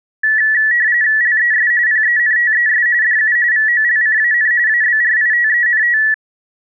RTTY (45.45 baud, 170 Hz shift), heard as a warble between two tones, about 1850 Hz centre. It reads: LES PENTES DU VOLCAN ABRITENT